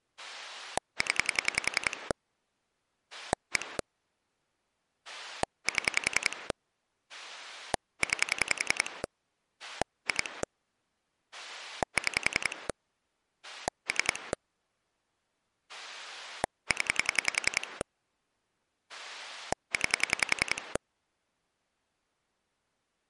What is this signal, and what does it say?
Pulse dialling, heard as a rotary dial, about 10 pulses a second. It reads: 0 1 7 9 2 6 3 0 9